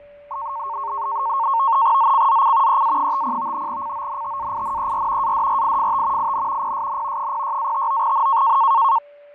NAVTEX (SITOR-B), 100 baud, 170 Hz shift, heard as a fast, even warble, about 1000 Hz centre, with fading, a steady whistle near 580 Hz and the noise inside a lift. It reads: ZCZC EA50 CONTAINER ADRIFT IN PSN 06-59N